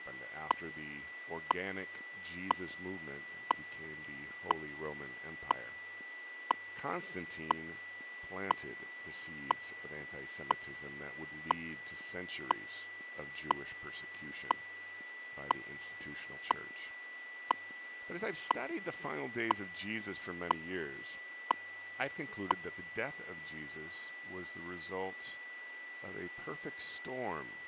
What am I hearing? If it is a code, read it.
Radio time signal (WWV, Colorado), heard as ticks, one a second, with a steady whistle near 1970 Hz and speech in English.